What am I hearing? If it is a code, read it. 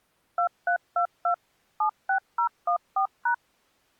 DTMF, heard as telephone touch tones, dialled by machine, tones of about 90 ms. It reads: 2322 76014#